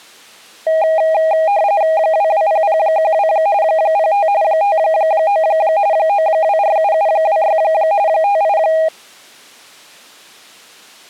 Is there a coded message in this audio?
Yes: RTTY (45.45 baud, 170 Hz shift) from 0.7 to 8.9 s, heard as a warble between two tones, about 720 Hz centre. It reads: 220012 05 59 9247726 58